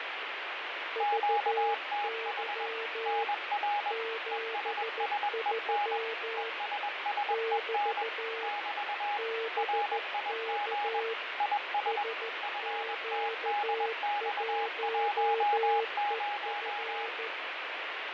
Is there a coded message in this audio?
Yes: Morse code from 0.9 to 17.3 s, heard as two keyed tones, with heavy radio static and fading. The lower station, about 14 wpm, 450 Hz: VY 73 <BT> BK SQ1EF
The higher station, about 21 wpm, 820 Hz: QTH NR ESSEN ESSEN <BT> RIG IS FTDX10